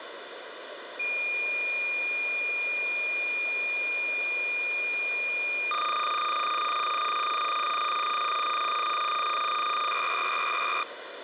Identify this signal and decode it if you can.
Cassette data (Kansas City type), 300 baud, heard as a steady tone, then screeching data, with tape hiss.